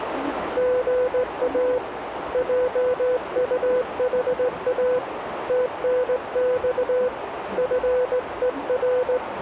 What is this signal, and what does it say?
Morse code, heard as a keyed tone, hand-sent with a straight key, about 18 wpm, 500 Hz, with radio static, a narrow filter and the noise inside a subway train. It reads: GA JUHA TNX FER